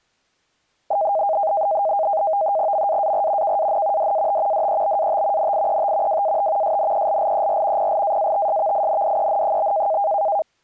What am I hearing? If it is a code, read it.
NAVTEX (SITOR-B), 100 baud, 170 Hz shift, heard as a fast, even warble, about 720 Hz centre. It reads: MAAR KAN DAT DEBAT NIET WAT SNELLER PLAATSVINDEN?